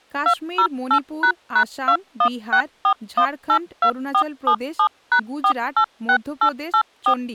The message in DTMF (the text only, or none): 208##2164182477#486884